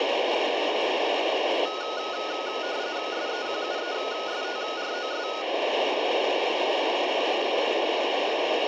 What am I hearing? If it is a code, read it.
RTTY (45.45 baud, 170 Hz shift), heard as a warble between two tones, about 1360 Hz centre, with radio static, room echo and the noise inside a lift. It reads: SEQUESTROS